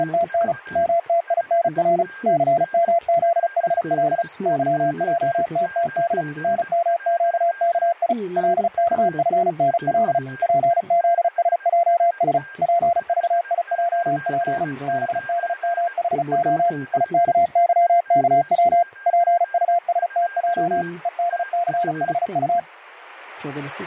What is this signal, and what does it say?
Morse code, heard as a keyed tone, machine-sent, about 35 wpm, 690 Hz, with a weaker station near 1600 Hz. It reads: … MTINR CMZHL YJTTD NMQKI LKFNL PZSJS PVIJP BDMHO IKYKW PUSTJ EDCHU